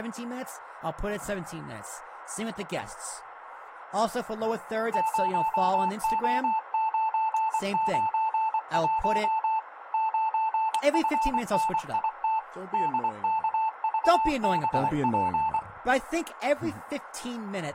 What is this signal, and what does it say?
Morse code, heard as a keyed tone, machine-sent, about 24 wpm, 880 Hz, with speech in English. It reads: 0O991 9FNIT DKVBP